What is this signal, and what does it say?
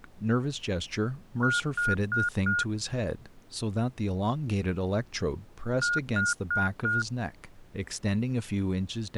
Beep code, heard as beeps, played twice, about 1430 Hz, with speech in English. 4 short. In AMI BIOS tables: system timer failure; in Dell tables: memory read or write failure.